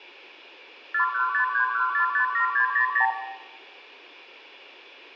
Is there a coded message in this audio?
Yes: multi-frequency trunk signalling (R2, with the far end's replies) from 0.9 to 3.1 s, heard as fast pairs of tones, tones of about 100 ms, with room echo. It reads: 41531457600